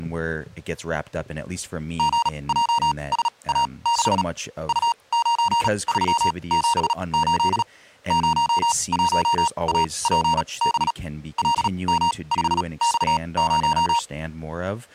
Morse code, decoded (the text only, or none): GJSA6 U9378 01APB LM5X0